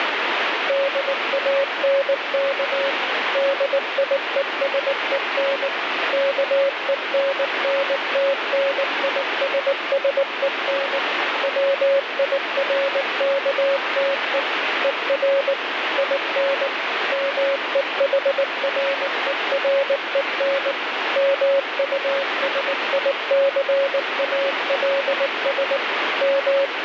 Morse code, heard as a keyed tone, machine-sent, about 19 wpm, 550 Hz, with heavy radio static. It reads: DANK DIESEN KENNTNISSEN WIRKTE ER IN MEHREREN MUSICALS …